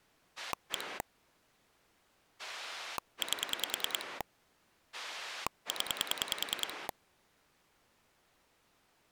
Pulse dialling, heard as a rotary dial, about 10 pulses a second. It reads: 1 8 0